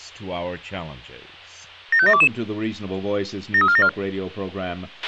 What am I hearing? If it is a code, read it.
Five-tone selective call (ZVEI), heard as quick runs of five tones, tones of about 70 ms, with a squelch burst at the end and speech in English. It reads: 75722 73474